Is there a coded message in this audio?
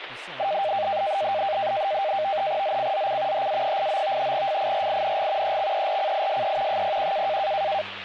Yes: NAVTEX (SITOR-B), 100 baud, 170 Hz shift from 0.4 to 7.8 s, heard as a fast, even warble, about 700 Hz centre, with radio static and speech in English. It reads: ZCZC HA89 FIRING EXERCISE 01